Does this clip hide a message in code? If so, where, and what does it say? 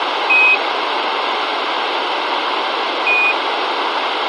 Yes: Quindar tones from 0.3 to 3.3 s, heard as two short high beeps, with radio hiss and room echo.